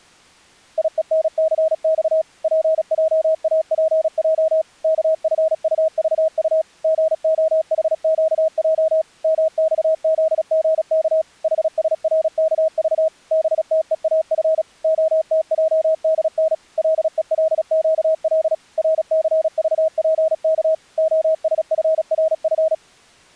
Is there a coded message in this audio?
Yes: Morse code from 0.7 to 22.8 s, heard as a keyed tone, machine-sent, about 36 wpm, 640 Hz. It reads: IENCX PJAPJ KFUVU GOHQJ MXZGK HSRKV BTEAF OTJDN LELQL RCVPK OSFRF